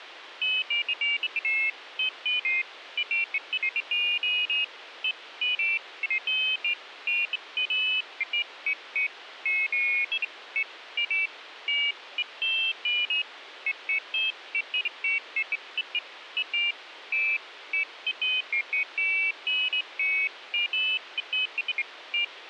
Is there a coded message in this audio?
No, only pairs of high tones at irregular times, with radio hiss.